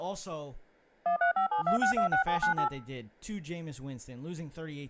DTMF, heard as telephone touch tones, dialled by machine, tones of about 110 ms, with speech in English. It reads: 13572626798